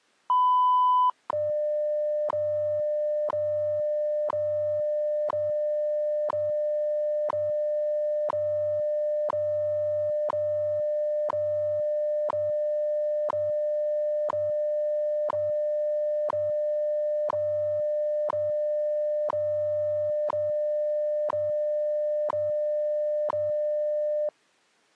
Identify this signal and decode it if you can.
Radio time signal (WWV, Colorado), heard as ticks, one a second.